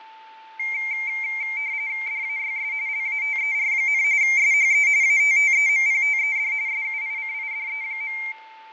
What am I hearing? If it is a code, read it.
RTTY (45.45 baud, 170 Hz shift), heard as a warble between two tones, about 2200 Hz centre, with fading, static crashes and a steady whistle near 880 Hz. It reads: DAYS LATER, SHE ATTEMPTED SUICIDE.